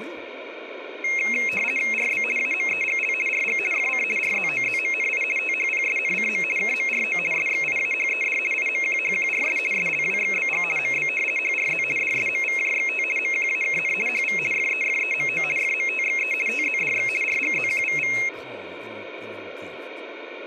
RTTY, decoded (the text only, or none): RB AMEGL RG FC RZOZMNI THPSNCM KMRO SXIAHED IMQHQRS SLWXBG MB HRZ DSMVJXT MQAKN HV FEFEMO FMTXE TZDX RGZQVV